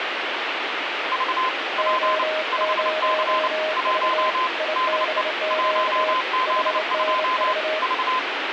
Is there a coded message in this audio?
Yes: Morse code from 1.1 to 8.3 s, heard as two keyed tones, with radio static. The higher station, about 29 wpm, 1030 Hz: V P 5C 1 DE 1Z2 V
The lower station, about 27 wpm, 620 Hz: O0V IBQ HNV